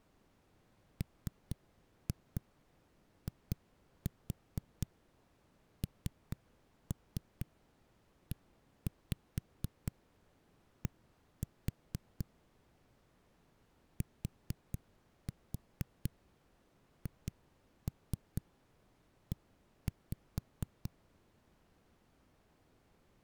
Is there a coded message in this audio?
Yes: tap code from 1.0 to 20.9 s, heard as knocks on a wall, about 4 knocks a second. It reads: MINED THE